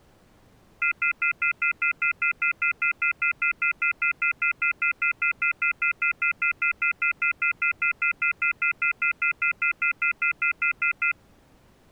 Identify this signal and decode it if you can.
Telephone call progress tone (North American plan), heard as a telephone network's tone, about 1400, 2050, 2450, 2600 Hz, 0.1 s on and 0.1 s off. Off-hook warning tone.